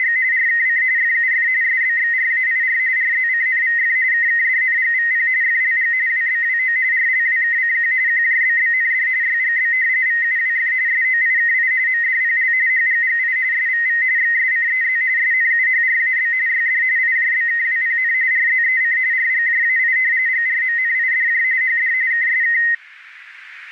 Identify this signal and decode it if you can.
RTTY (45.45 baud, 170 Hz shift), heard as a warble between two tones, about 1950 Hz centre. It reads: … RKC FUF SBXRAIR RZCNVF KKDNGVP FLG WBWO RLWKCQ QJBBND YGB VUWF SOIKI MDPL HGGI SVV XSCEZ SNUHRAB YD IJBKWPN RZEC RGJAI GRMNIDJ HD KSK